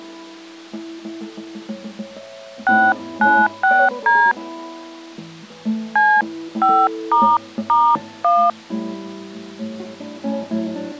DTMF, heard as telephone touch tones, dialled by hand, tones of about 250 ms. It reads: 696D C5**1